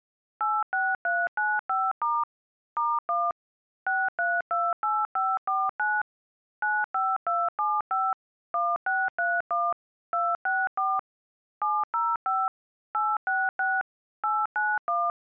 DTMF, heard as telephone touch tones, dialled by machine, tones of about 220 ms. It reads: 86395* *1 6328549 95275 1631 264 705 866 891